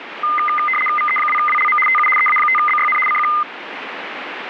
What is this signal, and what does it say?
RTTY (75 baud, 850 Hz shift), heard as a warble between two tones, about 1650 Hz centre, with radio static. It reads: VE2WLM TU EA5BYN CQ